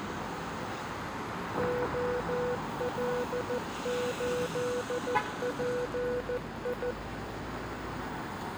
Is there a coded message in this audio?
Yes: Morse code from 1.5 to 7.0 s, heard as a keyed tone, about 14 wpm, 490 Hz, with street noise. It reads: OL8PI